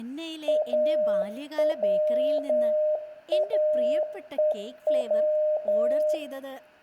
Morse code, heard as a keyed tone, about 10 wpm, 610 Hz, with room echo and speech in Malayalam. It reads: AWAEW